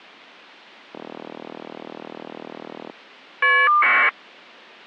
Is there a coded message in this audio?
Yes: caller ID data burst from 0.9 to 4.1 s, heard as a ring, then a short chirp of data, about 1200 baud.